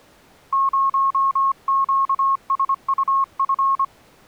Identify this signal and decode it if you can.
Morse code, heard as a keyed tone, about 25 wpm, 1090 Hz. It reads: 0QSUF